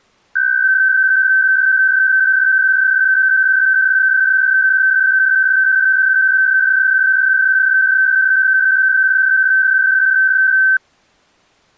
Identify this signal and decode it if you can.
PSK63 (62.5 baud), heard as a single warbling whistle, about 1550 Hz.